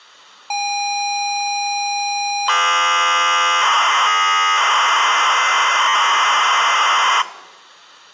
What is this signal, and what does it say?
ZX Spectrum tape loading, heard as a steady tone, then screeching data.